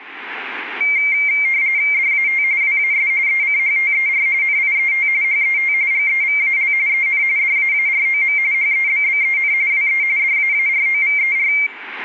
RTTY (45.45 baud, 170 Hz shift), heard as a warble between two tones, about 2200 Hz centre. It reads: DAT WAS ECHTER NIET HET GEVAL EN DAAROM HEBBEN WE DAAROVER